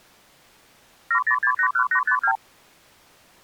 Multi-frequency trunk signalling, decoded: 70681852

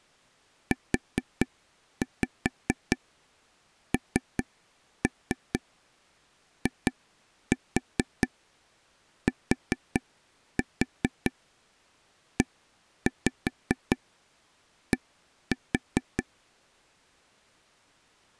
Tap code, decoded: UNITED

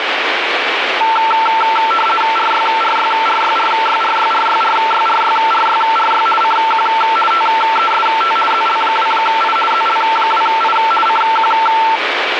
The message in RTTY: RYRYRYRYRYRYRYRYRYRY CQ TEST ZL2I ZL2I CQ

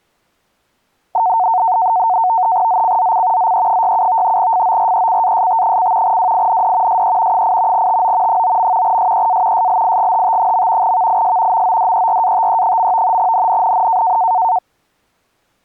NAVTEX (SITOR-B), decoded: ZCZC ZE67 FORECAST: WIND SE 8 TO 9. SEA SLIGHT. VIS MODERATE. NNNN

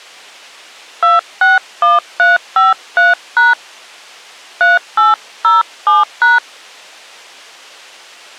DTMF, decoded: 261353# 3807#

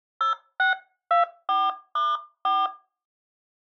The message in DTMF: 0624*4

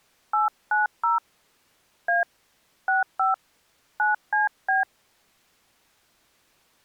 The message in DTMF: 890 A 65 9CB

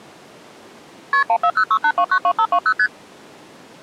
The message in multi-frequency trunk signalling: KP 14068292520 ST

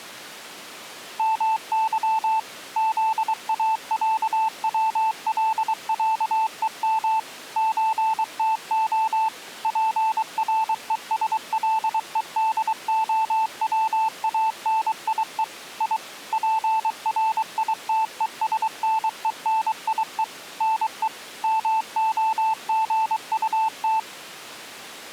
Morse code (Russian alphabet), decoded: МЫ ЗАЯВЛЯЕМ ЧТО ПРЕСЛЕДОВАНИЕ И ПРИТЕСНЕНИЕ НЕ МОГУТ

